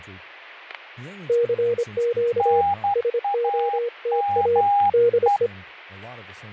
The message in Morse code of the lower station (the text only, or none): CQ SOTA DE